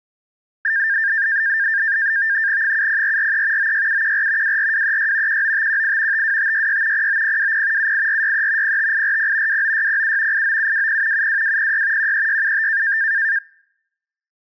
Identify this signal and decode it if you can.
NAVTEX (SITOR-B), 100 baud, 170 Hz shift, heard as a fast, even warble, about 1700 Hz centre. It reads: 70443 96714 24236 19518 52566 09020 78463 05840 29607 89720 72206 13675